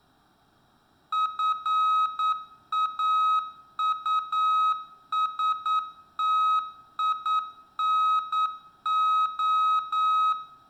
Morse code, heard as electronic beeps, machine-sent, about 9 wpm, 1270 Hz, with room echo. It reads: FAUSTINO